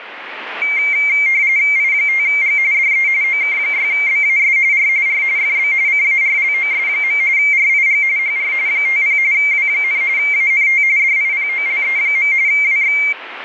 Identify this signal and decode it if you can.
RTTY (45.45 baud, 170 Hz shift), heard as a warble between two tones, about 2200 Hz centre, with radio static. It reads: I5G DE OK6BAS R R FB CARLOS. RIG HR 50 W, ANT DIPOLE. WX